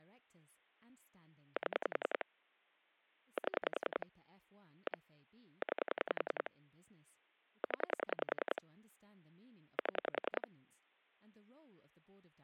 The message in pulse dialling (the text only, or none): 7 7 1 9 0 7